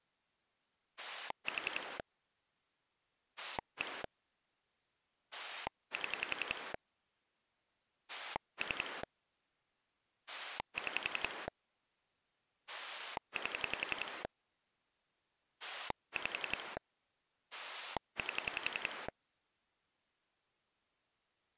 Pulse dialling, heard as a rotary dial, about 11 pulses a second. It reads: 4 1 7 3 6 8 5 8